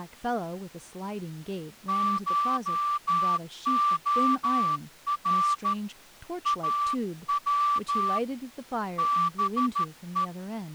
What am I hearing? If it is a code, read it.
Morse code (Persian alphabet), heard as a whistle, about 13 wpm, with speech in English. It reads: شعر او به